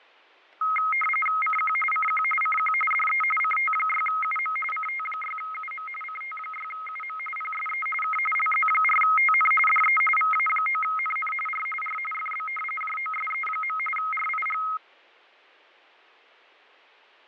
RTTY (45.45 baud, 850 Hz shift), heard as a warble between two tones, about 1700 Hz centre, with fading and static crashes. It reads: CQ CQ CQ DE CT6UM CT6UM CT6UM PSE K LZ4TN DE VA9NN R R FB JOSE. RIG